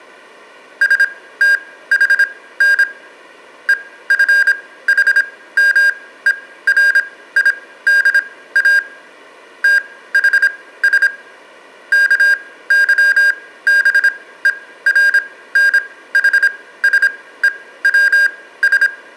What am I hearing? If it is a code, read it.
Morse code (Greek alphabet), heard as electronic beeps, machine-sent, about 26 wpm, spaced as for 16 wpm, 1600 Hz, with room echo. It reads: ΣΤΗΝ ΕΦΗΜΕΡΙΔΑ ΤΗΣ ΚΥΒΕΡΝΗΣΕΩΣ